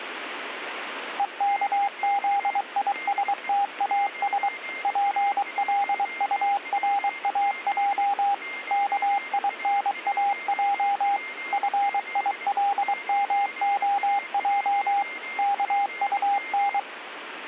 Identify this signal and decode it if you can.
Morse code, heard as a keyed tone, machine-sent, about 23 wpm, 800 Hz, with radio static and a weaker station near 2110 Hz. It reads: EKZISTAS PLURAJ KINAJ FILMOJ KUN